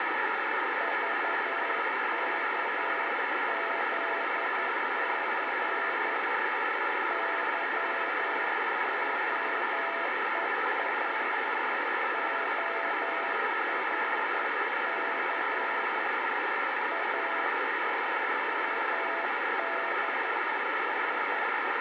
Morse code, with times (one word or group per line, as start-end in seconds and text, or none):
0.8-6.2 VKZC
7.1-16.1 YOELORC
16.9-21.4 AJBN